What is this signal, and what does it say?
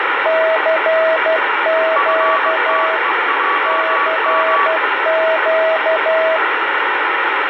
Morse code, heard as two keyed tones, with heavy radio static and fading. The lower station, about 12 wpm, 640 Hz: CQ CQ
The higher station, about 20 wpm, 1140 Hz: FTEJM